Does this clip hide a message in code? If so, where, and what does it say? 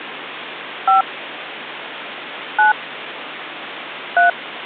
Yes: DTMF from 0.9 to 4.3 s, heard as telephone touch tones, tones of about 130 ms, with phone line noise. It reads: 5 9 3